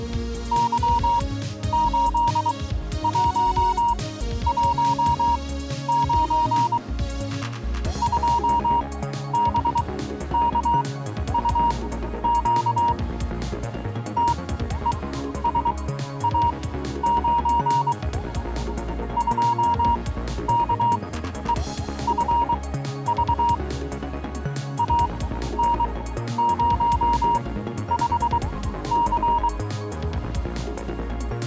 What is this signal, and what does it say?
Morse code, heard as a keyed tone, machine-sent, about 23 wpm, spaced as for 12 wpm, 940 Hz. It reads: Y8119 2BKUQ TESA9 2KEFV AN05C